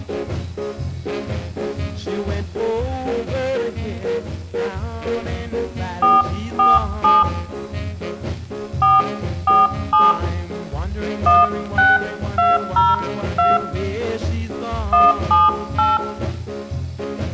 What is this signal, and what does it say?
DTMF, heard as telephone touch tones, dialled by hand, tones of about 190 ms, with room echo. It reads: 447 447 16202 178